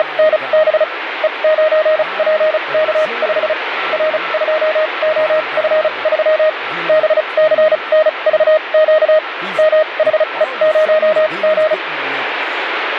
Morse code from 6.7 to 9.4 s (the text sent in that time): BCNVQ